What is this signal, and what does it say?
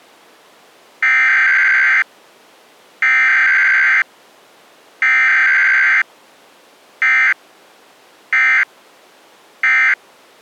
Emergency Alert System (SAME) tones (header bursts, then end-of-message bursts), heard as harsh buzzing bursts, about 520.83 baud.